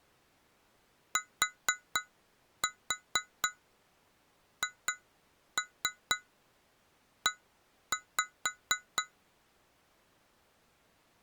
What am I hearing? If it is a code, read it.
Tap code, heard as taps on glass, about 4 knocks a second. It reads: THE